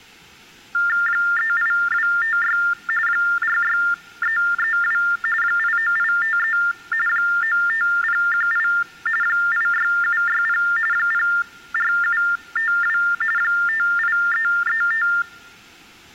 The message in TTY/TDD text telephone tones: 38256 46332 89853 95018 86760 04752 58335

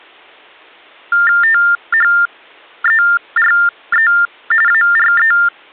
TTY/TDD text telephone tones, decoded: THERE ARE

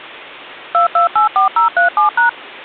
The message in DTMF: 2284037#

